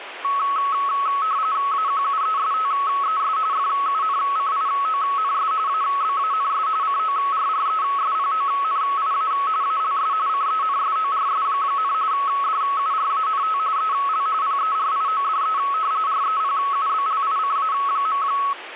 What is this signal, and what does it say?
RTTY (45.45 baud, 170 Hz shift), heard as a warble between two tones, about 1200 Hz centre, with radio static. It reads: AQUESTES FUNCIONS ABANS CORRESPONIA ALS CENSORS, DURANT EL PERIODE REPUBLICA.